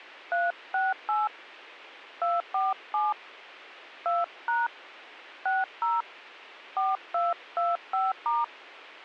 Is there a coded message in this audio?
Yes: DTMF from 0.3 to 8.4 s, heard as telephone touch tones, dialled by hand, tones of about 190 ms. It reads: 368 247 2# 60 4225*